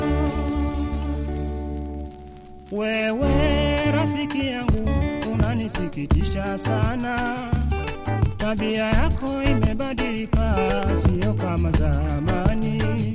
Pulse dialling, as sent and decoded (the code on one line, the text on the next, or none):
none